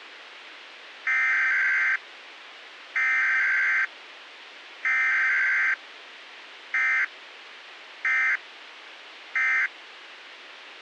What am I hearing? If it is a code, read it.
Emergency Alert System (SAME) tones (header bursts, then end-of-message bursts), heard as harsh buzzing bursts, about 520.83 baud, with radio hiss.